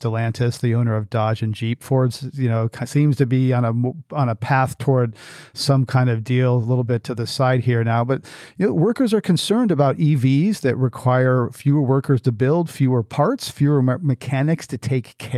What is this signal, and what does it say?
Speech in English. There is no code.